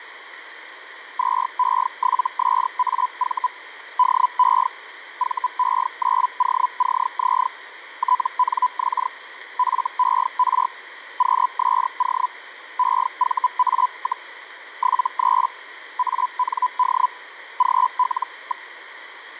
Hellschreiber (Feld-Hell, 122.5 baud), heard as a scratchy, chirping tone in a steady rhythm, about 1000 Hz, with radio static. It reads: 2E7SAV DE VE9OCZ TNX FER QSO EVA, 73 AND GL.